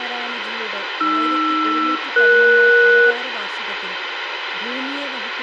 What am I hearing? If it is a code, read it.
Aircraft SELCAL, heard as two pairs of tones, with radio hiss, room echo and speech in Malayalam. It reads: AR-ES